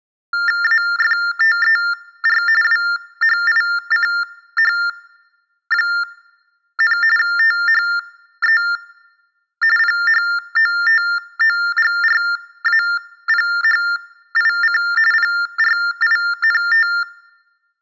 TTY/TDD text telephone tones (45.45 baud Baudot), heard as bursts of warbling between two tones, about 400 Hz shift, 1600 Hz centre. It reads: AFTER WHICH, THE PHOTOGRAPHIC PRINT